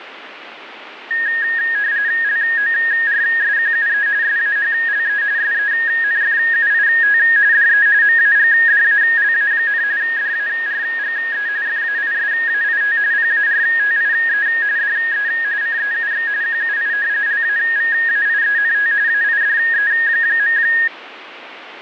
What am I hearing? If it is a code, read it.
RTTY (45.45 baud, 170 Hz shift), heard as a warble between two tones, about 1750 Hz centre, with radio static and fading. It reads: LORSQUE SAHLE SENFUIT DE MAGDALA, DARGE FAISAIT PARTIE DE CEUX QUI LAVAIENT AIDE.